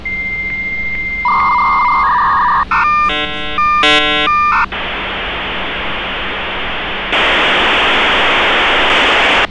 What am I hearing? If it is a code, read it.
Dial-up modem handshake (V.34 or later), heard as a whistle, warbles, then hiss, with street noise.